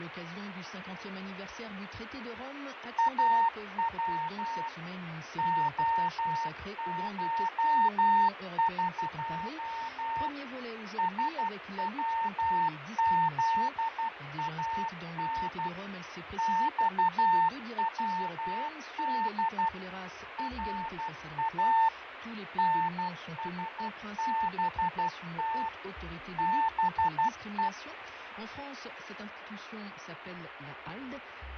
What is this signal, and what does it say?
Morse code (Persian alphabet), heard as a keyed tone, machine-sent, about 12 wpm, 900 Hz, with radio static and fading. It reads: او عشق سوزان خود را نسبت به